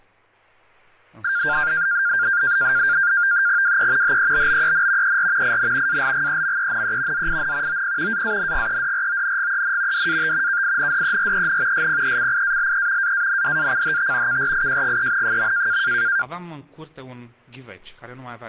NAVTEX (SITOR-B), 100 baud, 170 Hz shift, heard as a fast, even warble, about 1500 Hz centre. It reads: WE HEBBEN ER IN ALGEMENE ZIN OP AANGEDRONGEN DAT KINDEREN SPECIALE AANDACHT KRIJGEN.